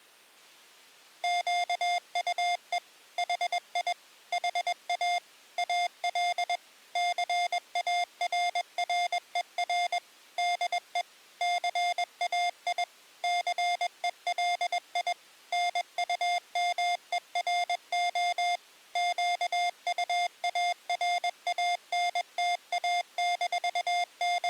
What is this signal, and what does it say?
Morse code, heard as electronic beeps, machine-sent, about 21 wpm, 700 Hz. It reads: QUE HI HA AL CARRER DE CAI CELI NUMERO …